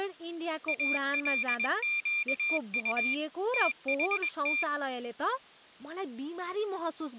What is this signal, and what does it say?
Morse code (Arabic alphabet), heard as a high beeper, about 21 wpm, 2400 Hz, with speech in Nepali. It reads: القط تحت